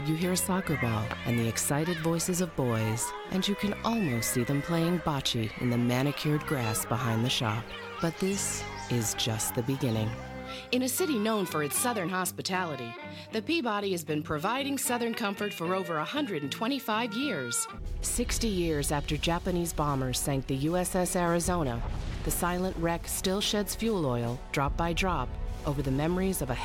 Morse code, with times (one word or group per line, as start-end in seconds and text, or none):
none